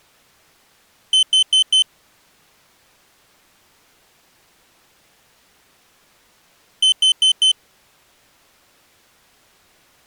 Alarm pattern, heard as an alarm's beeps, played twice, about 3050 Hz. Temporal four. Carbon monoxide.